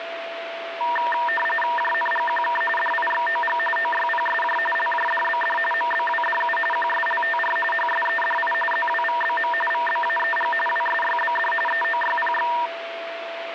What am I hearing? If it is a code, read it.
RTTY (45.45 baud, 850 Hz shift), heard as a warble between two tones, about 1380 Hz centre, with radio static and a steady whistle near 670 Hz. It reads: JNGQK DIXOG OYPSJ LJDBD MBWDU QSLTR HSEDI ZWVBM VBAEG WSYBD EOYPX